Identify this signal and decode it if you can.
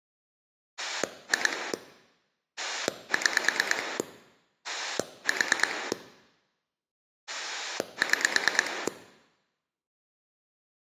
Pulse dialling, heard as a rotary dial, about 9 pulses a second. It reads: 2 6 4 6